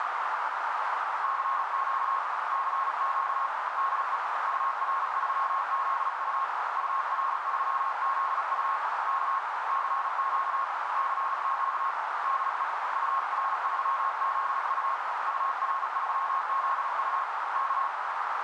Morse code, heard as a keyed tone, hand-sent with a paddle, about 37 wpm, 1080 Hz, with heavy radio static and a narrow filter. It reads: CQ CQ DE UR3ZU UR3ZU K CQ CQ DE UR3ZU UR3ZU K